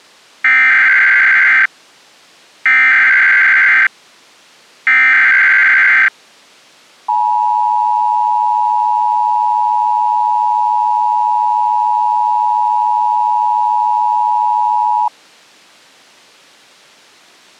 Emergency Alert System (SAME) tones (header bursts, then the 853 and 960 Hz attention tone), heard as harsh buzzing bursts, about 520.83 baud.